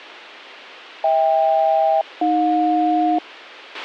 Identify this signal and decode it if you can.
Aircraft SELCAL, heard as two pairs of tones, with a squelch burst at the end. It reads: HK-AJ